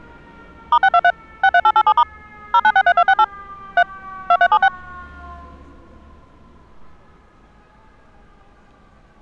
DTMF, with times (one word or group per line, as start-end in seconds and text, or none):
0.7-1.1 *623
1.4-2.0 63887*
2.5-3.2 0963268
3.8-3.8 3
4.3-4.7 2376